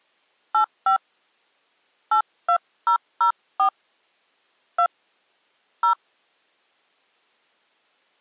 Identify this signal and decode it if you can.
DTMF, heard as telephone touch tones, dialled by hand, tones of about 100 ms. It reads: 85 82004 2 0